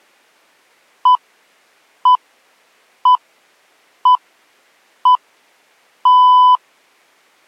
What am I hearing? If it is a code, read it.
Radio time signal (six pips, as the Greenwich Time Signal), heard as pips.